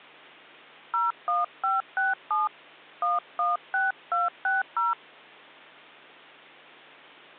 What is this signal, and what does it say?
DTMF, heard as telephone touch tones, dialled by hand, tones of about 170 ms, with hum. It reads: 01567 116260